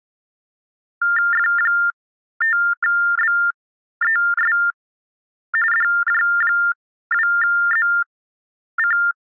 TTY/TDD text telephone tones (45.45 baud Baudot), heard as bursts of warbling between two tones, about 400 Hz shift, 1600 Hz centre. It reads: F5BES DJ2ZC